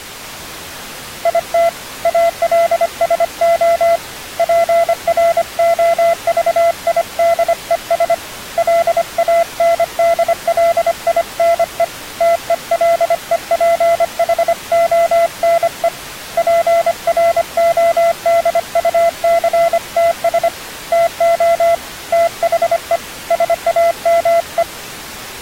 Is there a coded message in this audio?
Yes: Morse code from 1.2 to 24.7 s, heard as a keyed tone, hand-sent with a paddle, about 25 wpm, 680 Hz. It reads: IT ALSO PROVIDES LANDLINE TELEPHONE PRODUCTS TO THE SAME